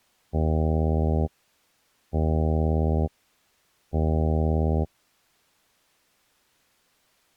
Ship horn signal, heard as a ship's horn, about 80 Hz. 3 short. At sea: I am operating astern propulsion.